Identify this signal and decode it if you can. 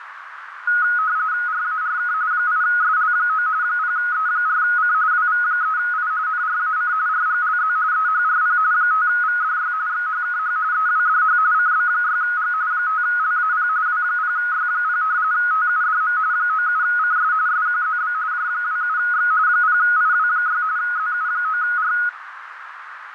RTTY (45.45 baud, 170 Hz shift), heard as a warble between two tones, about 1360 Hz centre, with radio static and a narrow filter. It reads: RARK 8SL9 0E4C WV3I NRAC RGLZ EHRP 5VDY XHKH EWDH CB6G 5LAP W0Y0 TUDM 97CS SQZB J27X 0IW6 ZU9R